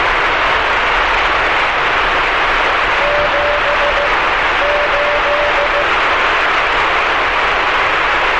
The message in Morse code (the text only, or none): 7 8